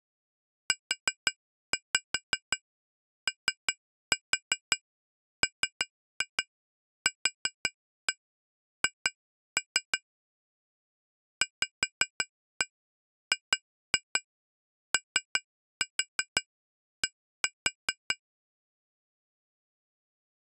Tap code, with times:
0.7-10.0 UOMQH
11.4-18.2 VGOD

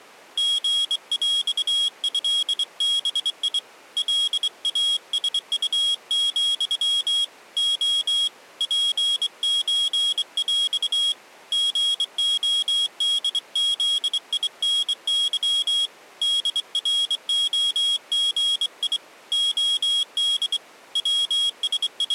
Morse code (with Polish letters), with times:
0.4-3.6 GŁĘBI
4.0-7.2 LASU,
7.6-8.3 O
8.6-11.1 PÓŁ
11.5-15.9 GODZINY
16.2-19.0 DROGI
19.3-20.6 OD
21.0-22.1 …

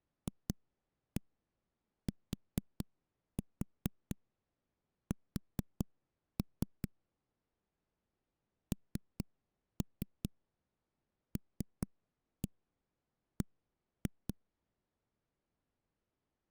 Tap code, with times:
0.3-6.9 FTS
8.7-14.3 NLB

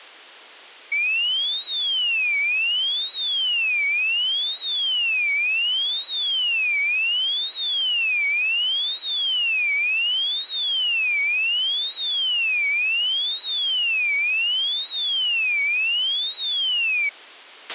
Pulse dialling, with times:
none

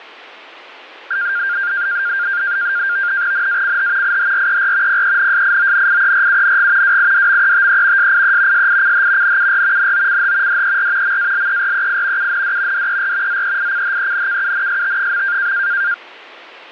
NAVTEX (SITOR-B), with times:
3.3-4.2 NACH
4.0-5.0 IHRER
4.9-7.0 PENSIONIERUNG
6.8-8.1 WIDMETE
8.0-8.7 SIE
8.5-9.4 SICH
9.2-9.9 NUR
9.8-10.6 NOCH
10.5-11.2 DER
11.0-12.3 MALEREI
12.2-12.9 UND
12.7-13.4 DER
13.3-15.5 ZEICHENKUNST.

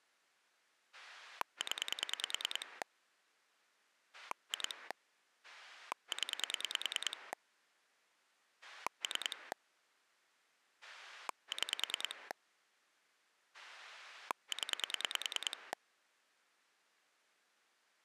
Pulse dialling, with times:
0.9-2.8 0
4.1-4.9 2
5.4-7.3 0
8.6-9.5 3
10.8-12.3 6
13.5-15.7 0

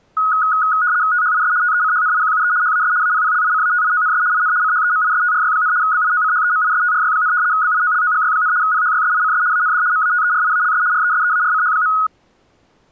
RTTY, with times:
1.1-1.5 THIS
1.6-2.5 TECHNIQUE
2.6-2.9 HAS
3.0-4.2 APPLICATIONS
4.3-4.5 IN
4.6-5.7 CHEMISTRY,
5.8-7.3 BIOCHEMISTRY,
7.5-8.5 BIOLOGY,
8.6-9.4 PHYSICS
9.5-9.8 AND
9.9-10.8 MATERIALS
10.9-11.9 RESEARCH.

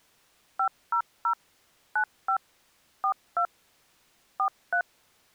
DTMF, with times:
0.6-1.3 500
2.0-2.4 95
3.0-3.5 42
4.4-4.8 43

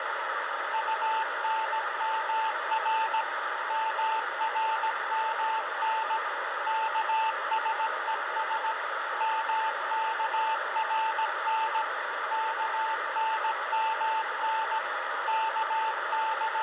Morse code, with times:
0.7-3.2 UNMR
3.7-6.2 MRMN
6.7-8.7 KSES
9.2-11.8 MKRN
12.3-14.8 KNMN
15.3-16.6 …

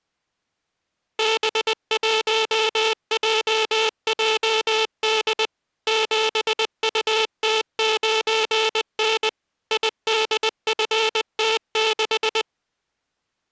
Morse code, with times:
1.2-5.5 B1JJD
5.9-9.3 7UT9N
9.7-12.4 IDFT6

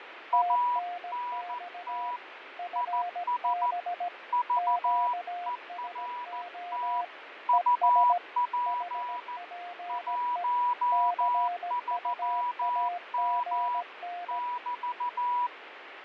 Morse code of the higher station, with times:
0.3-2.2 ANT
2.8-3.7 IS
4.3-7.0 VERT
7.5-9.4 UP
9.9-13.8 13M
14.3-15.5 <BT>

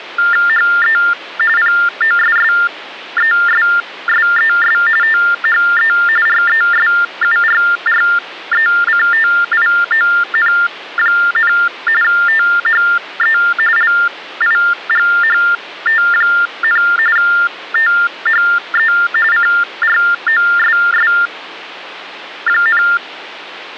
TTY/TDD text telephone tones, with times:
0.5-1.0 HE
1.6-4.8 POSSESSES
5.0-5.9 THE
6.3-11.5 RESURRECTION,
12.0-13.4 THE
13.8-16.8 LIGHT,
17.2-18.9 THE
19.3-22.8 CROSS,

